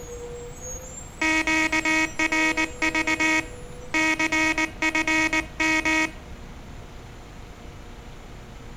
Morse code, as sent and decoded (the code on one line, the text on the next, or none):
--.- .-. ...- / -.-. ..-. --
QRV CFM